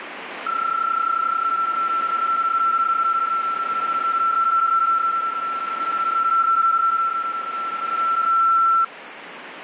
PSK31 (31.25 baud), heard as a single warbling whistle, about 1340 Hz, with radio static.